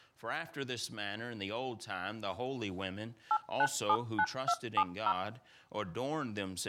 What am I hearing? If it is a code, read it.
DTMF, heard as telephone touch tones, dialled by machine, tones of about 60 ms. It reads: 8979270